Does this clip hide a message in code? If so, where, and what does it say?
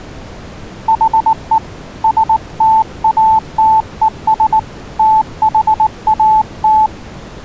Yes: Morse code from 0.8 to 6.9 s, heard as a keyed tone, hand-sent with a paddle, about 19 wpm, 880 Hz. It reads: HE STATES THAT